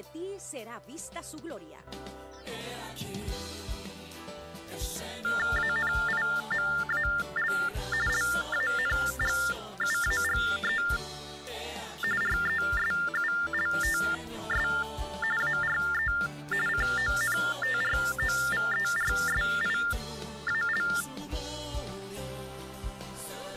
TTY/TDD text telephone tones (45.45 baud Baudot), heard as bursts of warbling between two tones, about 400 Hz shift, 1600 Hz centre. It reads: ANIMAL LANGUAGE RESULTS ARE CONTROVERSIAL